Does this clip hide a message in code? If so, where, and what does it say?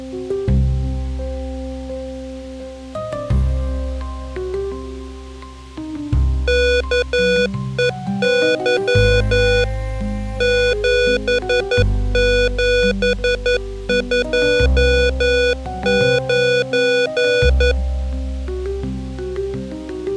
Yes: Morse code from 6.4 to 17.8 s, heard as electronic beeps, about 11 wpm, 490 Hz. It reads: KEY 7729